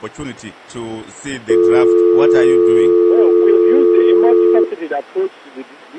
Telephone call progress tone (North American or UK plan), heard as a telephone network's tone, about 350, 440 Hz. Dial tone.